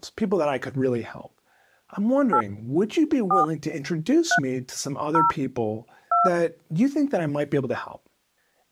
DTMF, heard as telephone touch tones, dialled by hand, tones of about 130 ms, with speech in English. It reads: 8 4 3 0 2